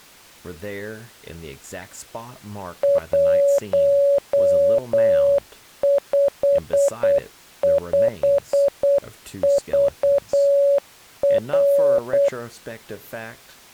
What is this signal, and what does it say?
Morse code, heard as a keyed tone, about 8 wpm, 560 Hz, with speech in English. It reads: 155VR